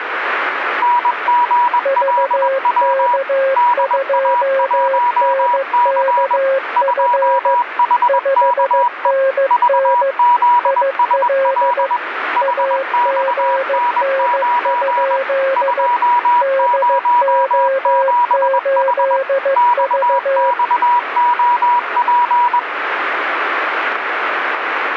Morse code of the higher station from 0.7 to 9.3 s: NGLW DA1C 2HKE

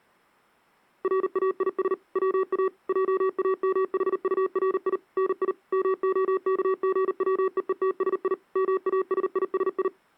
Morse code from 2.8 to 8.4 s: JAMHURI NI MOKGWEETSI

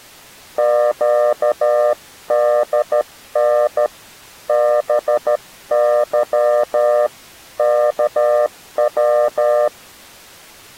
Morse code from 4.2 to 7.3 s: BY

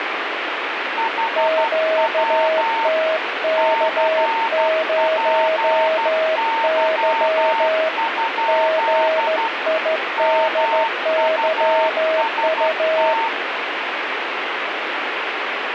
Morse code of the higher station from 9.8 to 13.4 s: MUST

